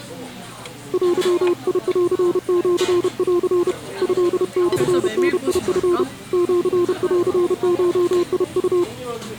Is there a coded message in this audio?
Yes: Morse code (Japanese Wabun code) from 0.9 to 8.9 s, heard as a keyed tone, hand-sent with a paddle, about 31 wpm, 350 Hz, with the noise of a crowd indoors. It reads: デンシン トモダチ シンゴウ